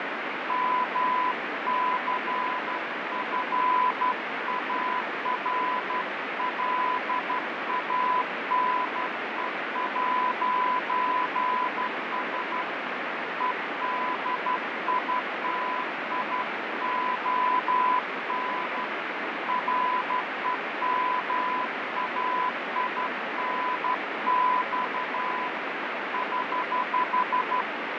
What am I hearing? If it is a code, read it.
Morse code, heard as a keyed tone, hand-sent with a straight key, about 12 wpm, 1000 Hz, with heavy radio static and fading. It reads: MCFARLANE'S EDITION REMAINX <HH>